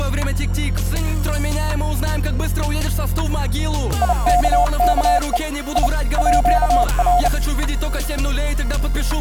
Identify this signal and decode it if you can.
Morse code (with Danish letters), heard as a keyed tone, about 32 wpm, 710 Hz. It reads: IKKE I ÅR